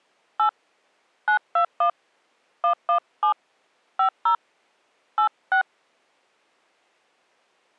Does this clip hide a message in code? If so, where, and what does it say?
Yes: DTMF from 0.4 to 5.6 s, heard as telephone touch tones, dialled by hand, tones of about 100 ms. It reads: 8 921 117 50 86